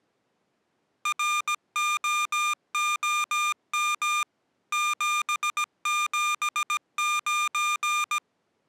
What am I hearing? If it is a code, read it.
Morse code, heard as electronic beeps, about 17 wpm, 1200 Hz. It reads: ROOM 779